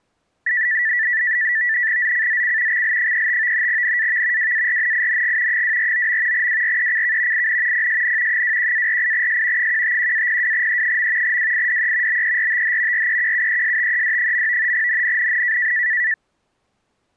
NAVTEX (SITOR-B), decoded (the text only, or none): ZCZC XL35 NAV WARNING 249. WRECK IN PSN 21-48S 151-02E. WIDE BERTH REQUESTED. NNNN